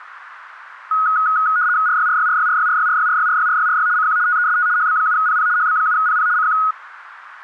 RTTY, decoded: RYRYRYRYRYRYRYRYRYRY CQ TEST HB7PP HB7PP CQ

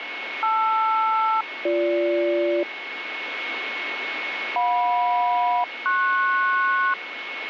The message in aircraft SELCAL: LR-BG JM-PS

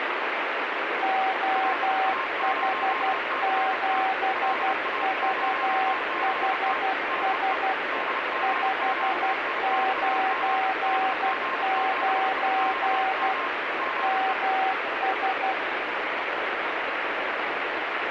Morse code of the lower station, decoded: OH7VHS 599 MS

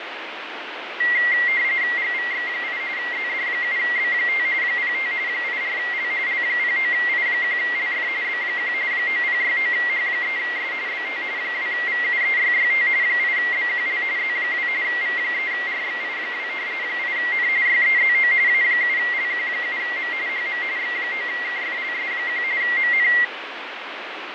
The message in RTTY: GVX8 ZD7B5 05 84L L09I1LF B1 9069H3S BT 2VUEYYT 8BQL Z2 V3RXI2 8N YEZO A7LQ7M HM X9KFLS1 MN

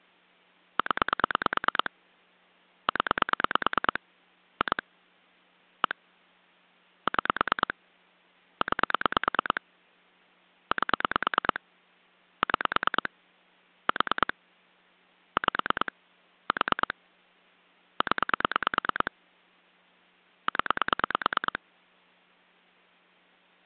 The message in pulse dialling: 0 0 2 1 6 9 8 6 4 5 4 0 0

